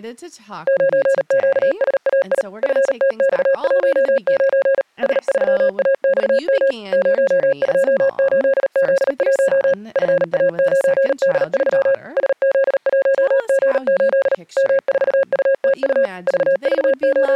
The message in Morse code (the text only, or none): 9QSAI FTX19 S3AXM 028Z1 FA9D3 SZ1G8 M4UTU …